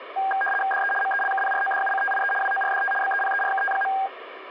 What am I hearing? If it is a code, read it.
RTTY (75 baud, 850 Hz shift), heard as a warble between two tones, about 1200 Hz centre, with radio static. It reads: DE MELKPRODUCTIE WORDT BEPERKT.